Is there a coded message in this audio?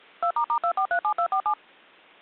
Yes: DTMF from 0.2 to 1.5 s, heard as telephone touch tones, dialled by machine, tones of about 80 ms. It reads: 2**2437247